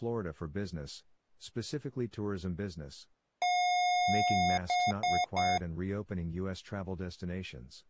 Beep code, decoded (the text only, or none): 1 long, 3 short